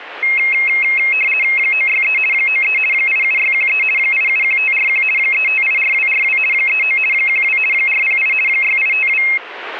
RTTY (50 baud, 450 Hz shift), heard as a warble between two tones, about 2350 Hz centre. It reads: 963 93 87613 871541 3584242 39 12 408 6852